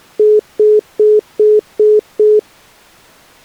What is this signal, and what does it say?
Telephone call progress tone (single-tone plan, as in most of Europe), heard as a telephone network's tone, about 420 Hz, 0.2 s on and 0.2 s off. Congestion tone.